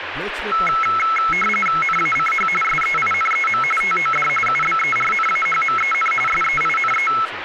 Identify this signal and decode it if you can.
RTTY (45.45 baud, 850 Hz shift), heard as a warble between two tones, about 1750 Hz centre, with radio static and speech in Bangla. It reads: NACH SEINEM TOD UBERNAHMEN SEINE